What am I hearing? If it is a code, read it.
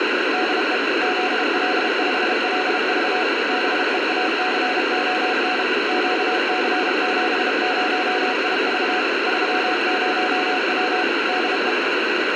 Morse code, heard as a keyed tone, machine-sent, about 32 wpm, 740 Hz, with radio hiss. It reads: DE ZL5LV BEACON QC70IV 30W DE